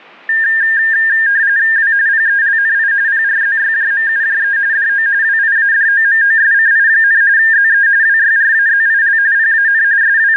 RTTY (45.45 baud, 170 Hz shift), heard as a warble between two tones, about 1700 Hz centre. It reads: W PELNI PRZYJMUJE DO WIADOMOSCI, ZE WYRAZIL PAN …